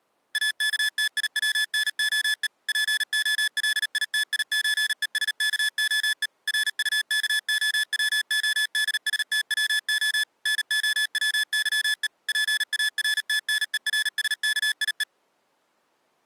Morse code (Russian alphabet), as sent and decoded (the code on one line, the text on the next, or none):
.- -.- - .. .-- -. --- . / .--. --- .-.. .. - .. ---. . ... -.- --- . / .-. ..- -.- --- .-- --- -.. ... - .-- --- / -. --- .-- -.-- . / .--. .- .-. - -. . .-. ... -.- .. .
АКТИВНОЕ ПОЛИТИЧЕСКОЕ РУКОВОДСТВО НОВЫЕ ПАРТНЕРСКИЕ